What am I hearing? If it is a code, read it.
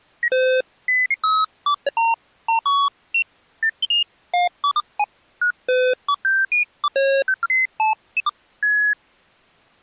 Electronic bleeps of random pitch and length. There is no code.